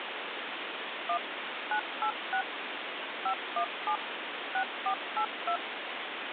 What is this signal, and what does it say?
DTMF, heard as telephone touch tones, dialled by machine, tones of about 80 ms, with phone line noise. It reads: 1 986 517 6482